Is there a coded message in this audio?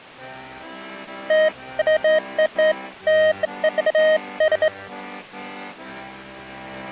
No, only beeps of irregular length.